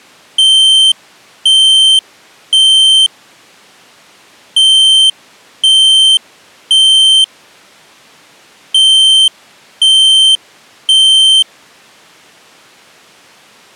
Alarm pattern, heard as an alarm's beeps, played three times, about 3100 Hz. Temporal three. Smoke or fire, evacuate.